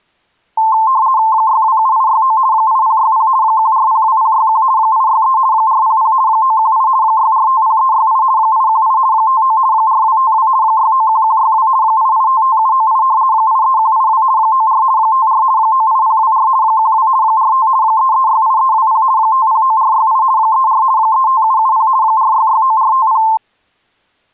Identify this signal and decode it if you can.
RTTY (50 baud, 170 Hz shift), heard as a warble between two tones, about 970 Hz centre. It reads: 627869 8060 1402061 863 400 918 6450368 818 59 4252 691162 8855798 83182 94 54 98024 12 45 3368320 509468 34 35770 4669450